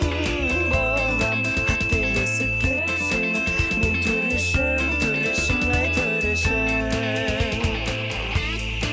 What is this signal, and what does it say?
FT8 (one signal), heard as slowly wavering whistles, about 6.25 baud, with radio static.